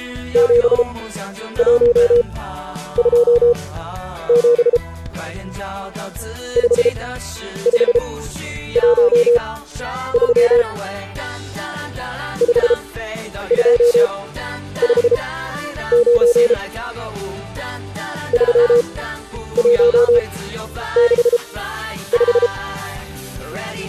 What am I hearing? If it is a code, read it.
Morse code, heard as a keyed tone, machine-sent, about 33 wpm, spaced as for 10 wpm, 480 Hz. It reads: 7127 5513 5259 3165